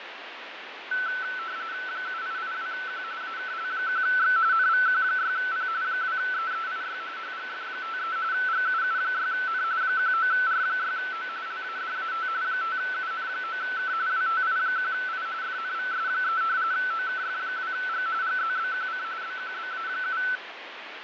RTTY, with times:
1.9-3.0 7882Q
3.2-4.4 AKL1X
4.5-5.7 NVQ6P
5.8-7.0 2EEIY
7.2-8.2 HGF53
8.3-9.6 GUU6N
9.8-11.3 19R6O
11.5-12.3 LADAT
12.4-13.9 5UN9K
14.1-15.3 WTI1I
15.4-16.4 FNVS3
16.7-18.1 OKF2G
18.2-19.0 GZBQC
19.2-20.2 BQBA7

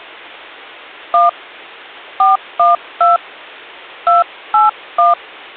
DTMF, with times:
1.1-1.3 1
2.2-3.2 412
4.1-5.1 281

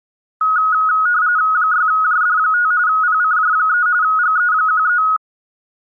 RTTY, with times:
1.5-2.7 6JD5
2.9-3.9 PCJ3
4.0-5.0 GE13

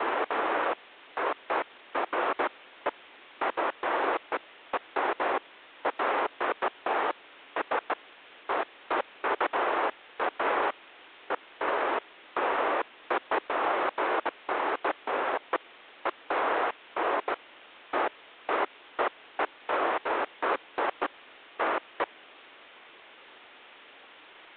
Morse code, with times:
none

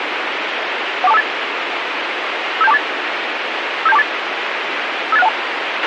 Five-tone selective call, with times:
1.0-1.2 14258
2.6-2.8 57248
3.9-4.0 57248
5.1-5.3 58612

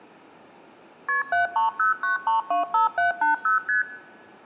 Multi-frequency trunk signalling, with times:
1.1-1.2 KP
1.3-3.6 7309325780
3.7-3.8 ST

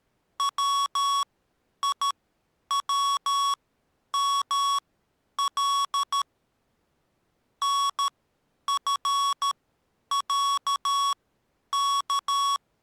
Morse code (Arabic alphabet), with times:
0.4-6.2 ويومل
7.6-12.6 نفعك

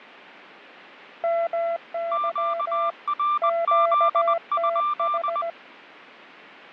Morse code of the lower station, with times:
1.2-2.9 MY
3.4-5.5 QTH

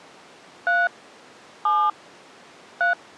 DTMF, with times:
0.7-0.9 3
1.7-1.9 7
2.8-2.9 3

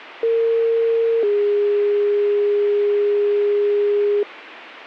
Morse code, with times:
none

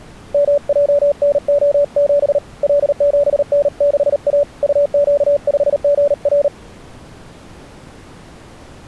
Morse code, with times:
0.3-2.4 MJNO7
2.6-4.4 L7N6A
4.6-6.5 UQ5GR

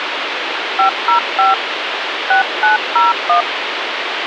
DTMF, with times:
0.8-1.5 505
2.3-3.4 6901

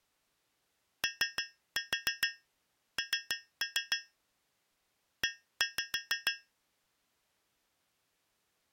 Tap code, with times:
1.0-4.0 ON
5.2-6.3 E

